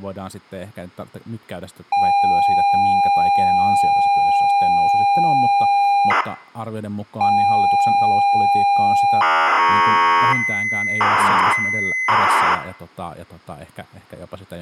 ZX Spectrum tape loading, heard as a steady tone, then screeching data, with room echo and speech in Finnish.